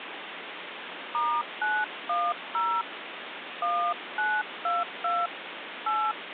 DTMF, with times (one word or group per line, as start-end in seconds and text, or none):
1.1-2.8 *910
3.6-5.3 1922
5.9-6.1 8